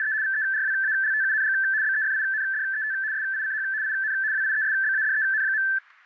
RTTY (75 baud, 170 Hz shift), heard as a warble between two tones, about 1650 Hz centre. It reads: … VERWALTUNG BEFINDET SICH IN WIESBADEN.